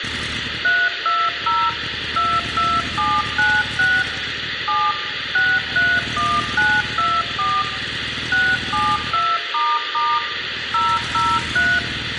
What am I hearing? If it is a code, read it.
DTMF, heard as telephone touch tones, dialled by machine, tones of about 240 ms, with radio hiss. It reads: 320 22796 7 631924 672** 003